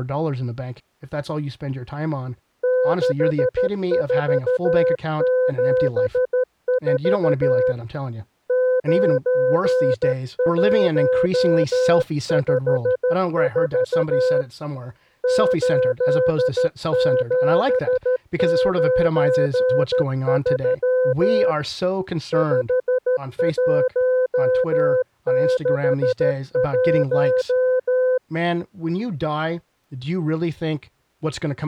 Morse code, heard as a keyed tone, hand-sent with a paddle, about 13 wpm, 510 Hz, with speech in English. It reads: 6474 9154 8793 5161